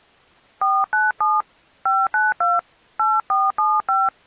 DTMF, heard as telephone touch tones, dialled by hand, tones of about 220 ms. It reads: 497 592 8475